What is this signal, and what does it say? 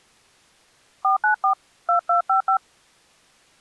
DTMF, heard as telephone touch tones, dialled by hand, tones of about 110 ms. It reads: 494 2255